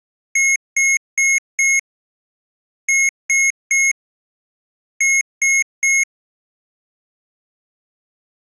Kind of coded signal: beep code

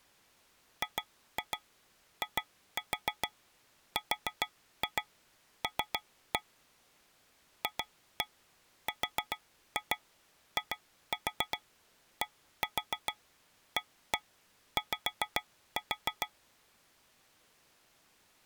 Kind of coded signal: tap code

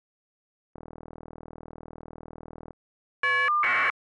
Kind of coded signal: caller ID data burst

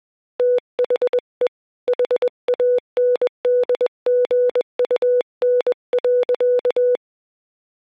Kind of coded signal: Morse code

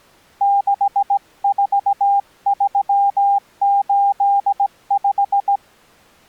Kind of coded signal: Morse code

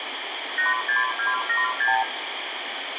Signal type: multi-frequency trunk signalling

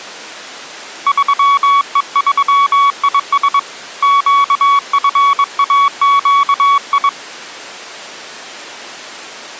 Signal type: Morse code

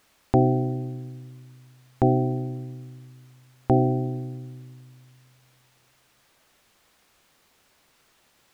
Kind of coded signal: clock strike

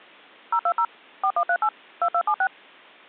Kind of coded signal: DTMF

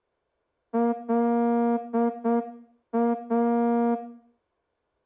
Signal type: Morse code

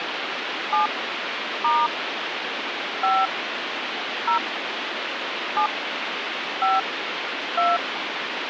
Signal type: DTMF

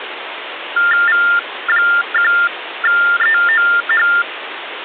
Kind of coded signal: TTY/TDD text telephone tones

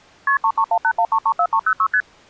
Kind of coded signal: multi-frequency trunk signalling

